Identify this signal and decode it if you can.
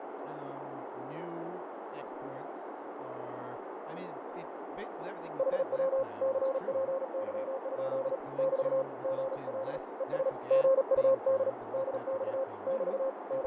Morse code, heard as a keyed tone, hand-sent with a paddle, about 37 wpm, 530 Hz, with heavy radio static, fading, a narrow filter and speech in English. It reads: HW CPY? <BT> GL ES GUD DX <BT> …